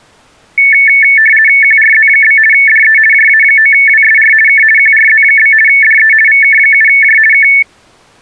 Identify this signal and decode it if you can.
RTTY (50 baud, 450 Hz shift), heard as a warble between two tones, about 2000 Hz centre. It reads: QRZ? DE JA9WSR K QRZ? DE VK7J K